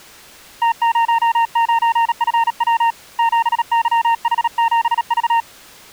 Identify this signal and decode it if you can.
Morse code, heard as a keyed tone, hand-sent with a paddle, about 37 wpm, 920 Hz. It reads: T09FW 7YH7V